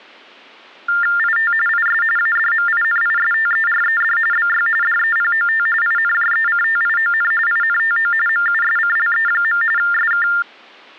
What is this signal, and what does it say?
TTY/TDD text telephone tones (45.45 baud Baudot), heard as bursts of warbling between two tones, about 400 Hz shift, 1600 Hz centre. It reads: IT IS ADMINISTERED BY DEPOT INJECTION INTO MUSCLE. SK